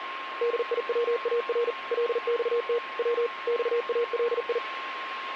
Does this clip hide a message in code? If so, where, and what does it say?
Yes: Morse code (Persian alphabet) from 0.4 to 4.6 s, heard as a keyed tone, machine-sent, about 40 wpm, 470 Hz, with radio static and a steady whistle near 1070 Hz. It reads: دیوار لخت و خالی